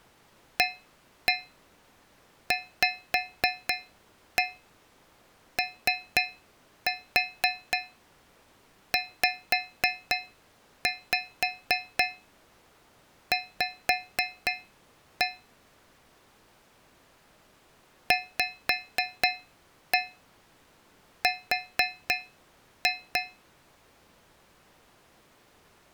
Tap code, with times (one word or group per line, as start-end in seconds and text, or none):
0.6-15.3 AVOZV
18.1-23.2 VR